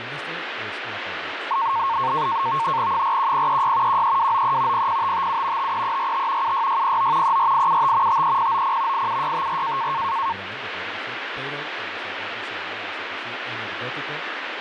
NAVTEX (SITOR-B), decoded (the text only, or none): 41036 13293 00557 53345 76609 34875 53090 87654